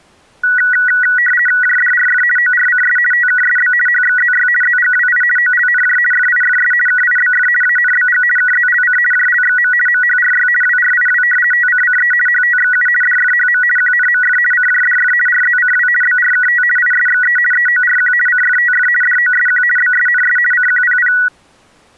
RTTY (50 baud, 450 Hz shift), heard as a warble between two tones, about 1700 Hz centre. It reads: JDRF ORCS TKSB HXZY ZGWI OLNJ FIFS KIBF ANBG KZLC JLXM MHRY WRIW TCCE HTXU DFHM QNMF CJDF RZCW BRKT ISXE EORQ CFTF DOSQ BSNS CQPP